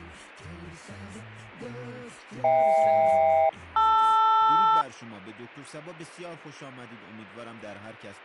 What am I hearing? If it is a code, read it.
Aircraft SELCAL, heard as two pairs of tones. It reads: HK-LR